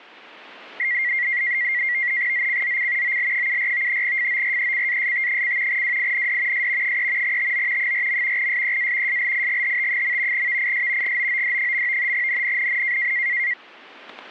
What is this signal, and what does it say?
NAVTEX (SITOR-B), 100 baud, 170 Hz shift, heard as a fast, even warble, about 2050 Hz centre, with static crashes. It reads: ZCZC OL74 FORECAST: WIND S 3 TO 4. SEA SLIGHT. VIS GOOD. NNNN